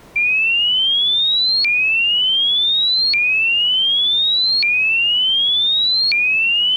A tone that sweeps in pitch again and again. There is no code.